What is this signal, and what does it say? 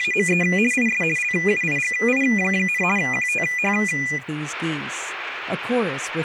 RTTY (50 baud, 450 Hz shift), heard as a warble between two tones, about 2200 Hz centre, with room echo. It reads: … IS LUIGI, QTH